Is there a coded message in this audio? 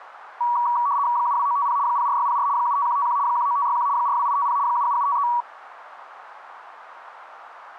Yes: RTTY (75 baud, 170 Hz shift) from 0.4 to 5.4 s, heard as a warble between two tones, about 1040 Hz centre, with radio static. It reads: 72950 04604 75151 19561 42850 77753